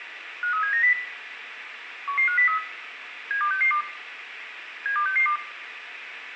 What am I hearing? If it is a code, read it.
Five-tone selective call (CCIR), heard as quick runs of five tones, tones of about 100 ms, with radio hiss and room echo. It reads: 53790 11503 72662 72662